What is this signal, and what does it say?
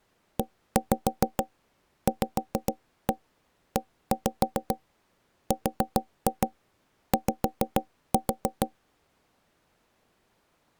Tap code, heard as knocks on wood, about 6 knocks a second. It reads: EVERY